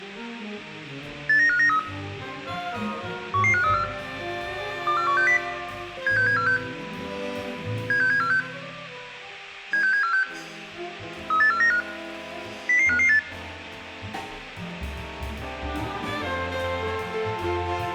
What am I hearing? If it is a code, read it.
Five-tone selective call (CCIR), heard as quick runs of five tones, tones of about 100 ms, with room echo. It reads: 89593 11534 24160 76746 76746 76746 38495 00558